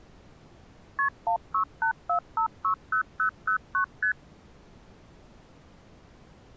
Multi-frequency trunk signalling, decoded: KP 1684560009 ST

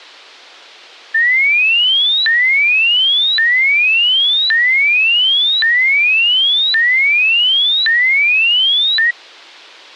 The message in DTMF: none

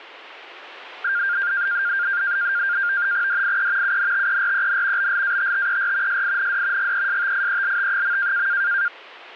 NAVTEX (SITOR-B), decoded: DIE UNTEREN BLATTER SIND GESTIELT.

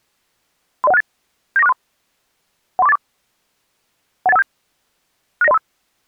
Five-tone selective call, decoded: 30168 79463 13484 18157 69035

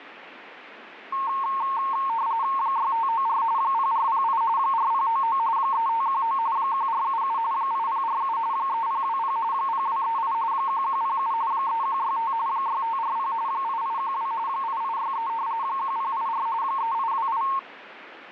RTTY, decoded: 6594 0408 4099 3519 1477 8047 3020 0238 1107 3165 6540 8812 8863 1084 3828

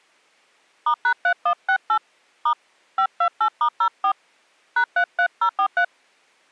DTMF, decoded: *#3168 * 528*04 #33043

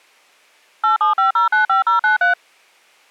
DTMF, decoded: 875095093

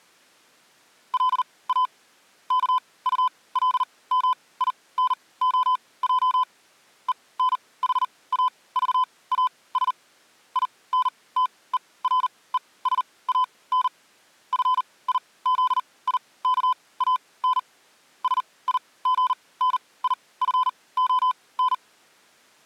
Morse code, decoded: LA KULMINOJ ENHAVAS INTERESAN FIZIKAN SIGNIFON

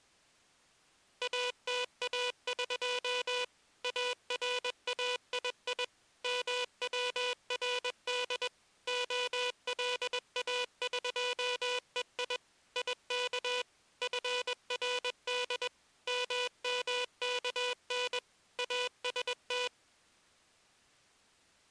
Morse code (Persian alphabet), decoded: اتاق ارایی مورد علاقهی یک فرد ممکن است

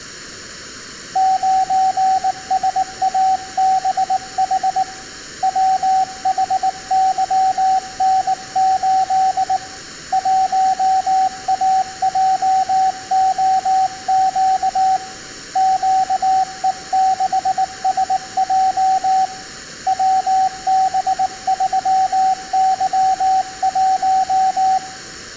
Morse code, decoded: 9SABH WHYN8 1AJOQ QE6SJ WB3Y1

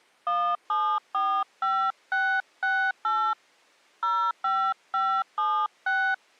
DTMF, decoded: 1745668 05576

